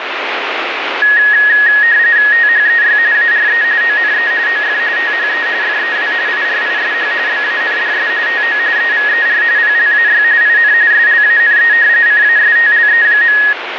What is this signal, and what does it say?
RTTY (45.45 baud, 170 Hz shift), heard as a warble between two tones, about 1800 Hz centre, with radio static. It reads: THEY ARE ONE OF THE FEW IRISH BANDS TO EVER PLAY IN SLANE CASTLE.